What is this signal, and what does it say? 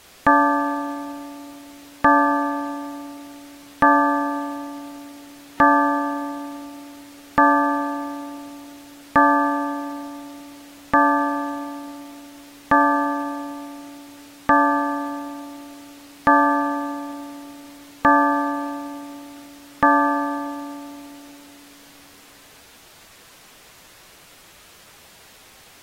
Clock strike, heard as a bell. 12. Twelve o'clock.